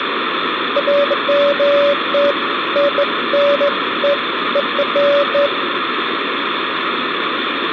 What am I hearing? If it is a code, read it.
Beeps of irregular length, with phone line noise and room echo. There is no code.